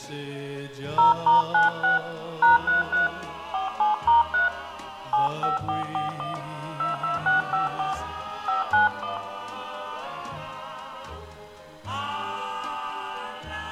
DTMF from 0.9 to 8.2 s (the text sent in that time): 0*96 #33 47*3 75441 22654